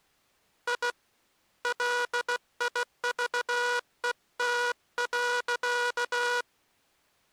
Morse code, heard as a buzzer, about 16 wpm. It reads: I LIVET.